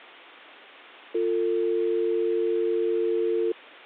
Telephone call progress tone (North American or UK plan), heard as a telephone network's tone, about 350, 450 Hz. Dial tone.